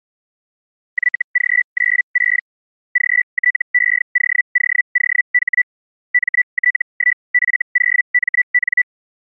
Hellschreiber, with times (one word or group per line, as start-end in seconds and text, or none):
0.9-2.4 YG96
2.9-5.6 GTEOOOH
6.1-8.8 MT1F0MN